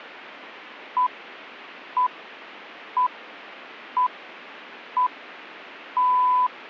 Radio time signal (six pips, as the Greenwich Time Signal), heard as pips.